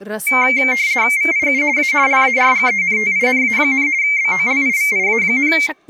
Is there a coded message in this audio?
Yes: RTTY (50 baud, 170 Hz shift) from 0.3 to 5.7 s, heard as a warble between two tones, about 2200 Hz centre, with speech in Sanskrit. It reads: VIU A LARGENTINA, BOLIVIA,